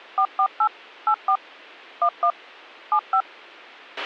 DTMF, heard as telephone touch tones, dialled by machine, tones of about 80 ms, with a squelch burst at the end. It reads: 448 84 11 75